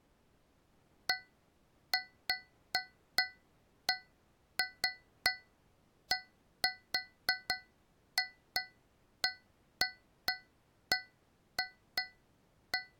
Irregular taps on a metal pipe. There is no code.